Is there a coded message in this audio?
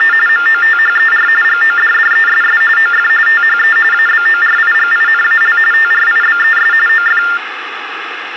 Yes: TTY/TDD text telephone tones (45.45 baud Baudot) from 0.0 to 7.4 s, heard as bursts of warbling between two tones, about 400 Hz shift, 1600 Hz centre, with phone line noise. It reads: … MOTHER GODDESS OF THE ABORIGINAL TRIBES OF